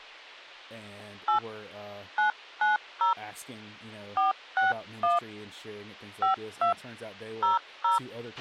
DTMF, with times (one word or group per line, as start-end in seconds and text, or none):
1.3-1.4 8
2.2-3.1 990
4.2-5.2 461
6.2-6.7 52
7.4-8.0 00